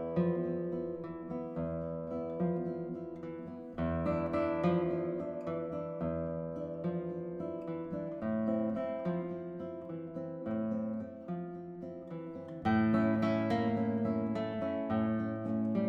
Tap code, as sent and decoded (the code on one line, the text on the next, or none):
none